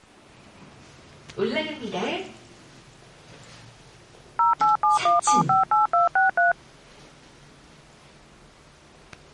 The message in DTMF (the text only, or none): 0871758263